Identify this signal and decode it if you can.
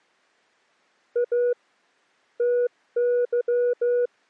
Morse code (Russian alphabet), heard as a keyed tone, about 14 wpm, 490 Hz. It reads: А ТЫ